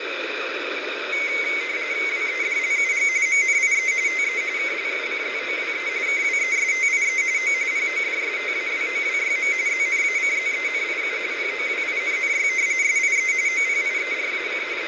RTTY (45.45 baud, 170 Hz shift), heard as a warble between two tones, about 2150 Hz centre, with radio static. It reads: WEDLUG MNIE TE KLUCZOWE KWESTIE O PODSTAWOWYM ZNACZENIU POWINNY SIE OPIERAC …